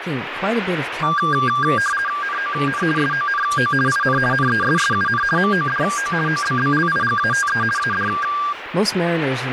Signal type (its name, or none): RTTY